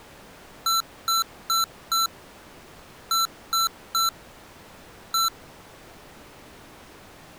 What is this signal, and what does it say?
Beep code, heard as beeps from a small speaker, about 1340 Hz. 4-3-1. In Phoenix BIOS tables: memory failure above the first 64 KB.